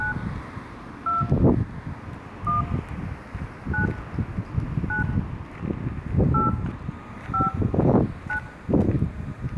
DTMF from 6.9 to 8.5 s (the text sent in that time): 5 9